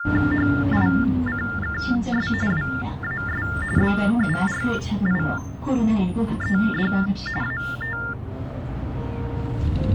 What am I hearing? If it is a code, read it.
TTY/TDD text telephone tones (45.45 baud Baudot), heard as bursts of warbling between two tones, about 400 Hz shift, 1600 Hz centre, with the noise inside a bus. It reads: HICKS WAS BURIED AT